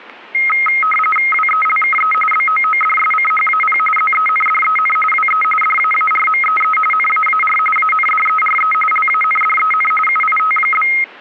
RTTY (45.45 baud, 850 Hz shift), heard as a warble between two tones, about 1700 Hz centre, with static crashes. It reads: WELKE BOODSCHAP ZENDEN WE DAARMEE NAAR ANDERE LANDEN UIT?